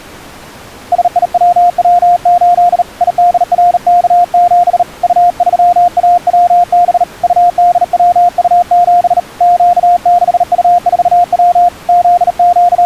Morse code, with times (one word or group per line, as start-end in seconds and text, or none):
0.9-2.8 SIWW8
3.0-4.8 IDRK7
5.0-7.0 U3AWB
7.2-9.2 UDWU7
9.4-11.7 Q6U4W
11.9-12.9 …